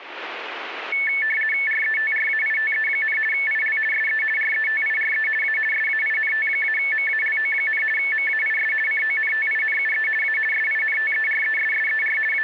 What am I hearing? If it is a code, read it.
RTTY (50 baud, 450 Hz shift), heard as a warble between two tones, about 2000 Hz centre. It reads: RETRAITE, IL SE RETIRE A SAINT-MALO, MAIS CONTINUE A SINTERESSER …